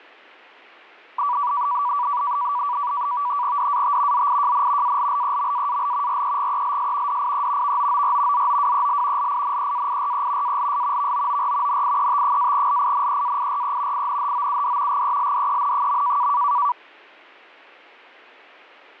NAVTEX (SITOR-B), 100 baud, 170 Hz shift, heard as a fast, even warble, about 1060 Hz centre. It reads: DAT ZIJN ALLEMAAL REGELS DIE VOOR ZOWEL LINEAIRE ALS VOOR NIET-LINEAIRE INHOUD GELDEN.